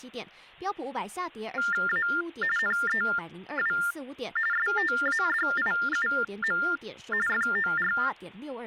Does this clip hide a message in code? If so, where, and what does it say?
Yes: TTY/TDD text telephone tones (45.45 baud Baudot) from 1.6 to 8.1 s, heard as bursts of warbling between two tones, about 400 Hz shift, 1600 Hz centre, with speech in Chinese. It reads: A NEW STADIUM FOR